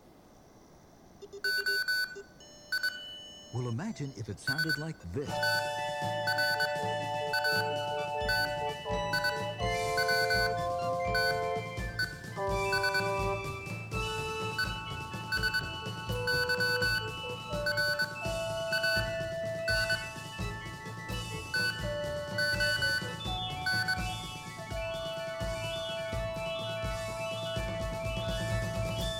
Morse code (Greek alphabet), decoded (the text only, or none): ΟΙ ΣΤΡΑΤΙΩΤΕΣ ΕΣΥΡΑΝ ΤΟΝ